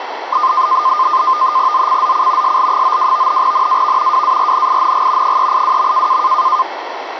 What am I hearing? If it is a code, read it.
NAVTEX (SITOR-B), 100 baud, 170 Hz shift, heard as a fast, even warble, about 1130 Hz centre, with radio static. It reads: ZCZC SL92 NAV WARNING 382.